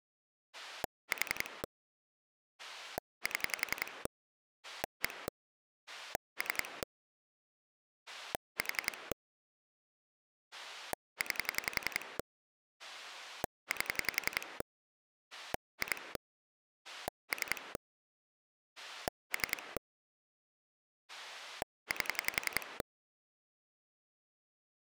Pulse dialling, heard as a rotary dial, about 11 pulses a second. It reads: 4 7 1 3 4 9 8 2 3 3 8